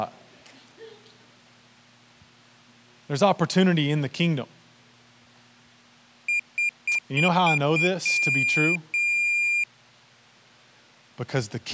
Beep code, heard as a piezo beeper, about 2400 Hz, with speech in English. 6 short, 2 long.